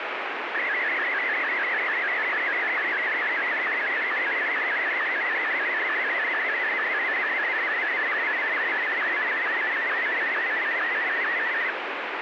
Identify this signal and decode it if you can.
SSTV (slow-scan television), Martin M1, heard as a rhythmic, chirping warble, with heavy radio static.